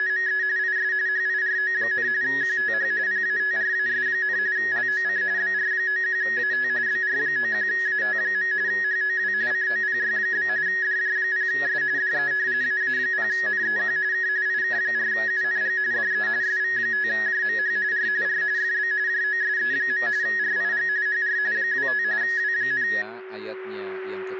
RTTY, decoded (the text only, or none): … IS HIRO, QTH PATRAS, LOC BR91AT BR91AT. HOW COPY? DJ0S DE AA0NEQ K IK4UNG DE SV5JMH R R FB JOSE. RIG HR 25 W,